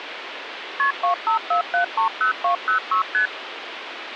Multi-frequency trunk signalling (R1, as on North American trunks), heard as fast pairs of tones, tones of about 110 ms, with phone line noise. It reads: KP 254730206 ST